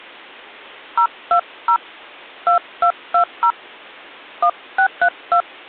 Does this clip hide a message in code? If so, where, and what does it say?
Yes: DTMF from 1.0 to 5.4 s, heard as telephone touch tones, dialled by hand, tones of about 90 ms. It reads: 020 2220 1632